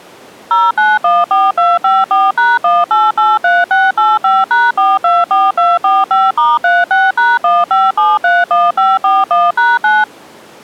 DTMF, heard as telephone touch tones, dialled by machine, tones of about 200 ms. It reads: 0914254#1883685#424245*36#15731541#9